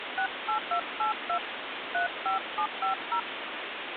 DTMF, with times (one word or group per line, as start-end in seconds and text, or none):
0.2-1.4 68282
1.9-3.2 35750